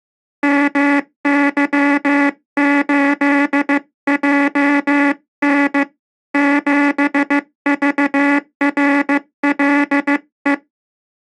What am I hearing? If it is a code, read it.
Morse code, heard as a buzzer, hand-sent with a paddle, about 15 wpm. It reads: MY8JN 7VRLE